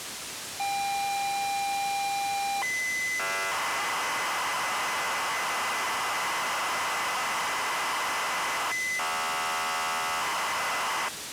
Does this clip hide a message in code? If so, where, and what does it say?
Yes: ZX Spectrum tape loading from 0.6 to 11.1 s, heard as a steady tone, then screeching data, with tape hiss.